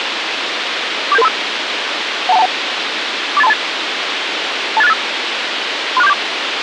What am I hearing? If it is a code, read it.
Five-tone selective call (EIA), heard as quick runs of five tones, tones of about 30 ms, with radio hiss. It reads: 47735 12121 48328 28685 36474